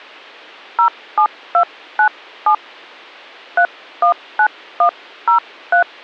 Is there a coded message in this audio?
Yes: DTMF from 0.8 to 5.8 s, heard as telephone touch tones, dialled by hand, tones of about 100 ms. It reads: 07297 319103